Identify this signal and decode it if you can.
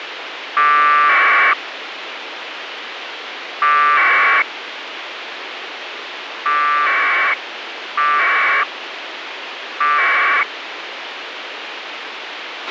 Packet radio (AX.25, as in APRS), 1200 baud, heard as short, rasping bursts, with radio hiss and a squelch burst at the end.